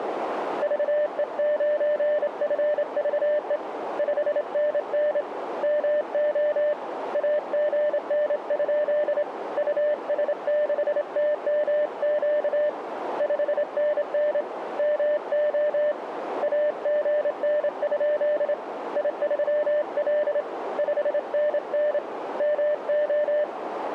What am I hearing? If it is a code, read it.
Morse code, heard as a keyed tone, hand-sent with a straight key, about 27 wpm, 600 Hz, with radio static and a narrow filter. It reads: VE9FVE 5NN MO AGN? US6TMQ 5NN MO AGN? I3L 5NN MO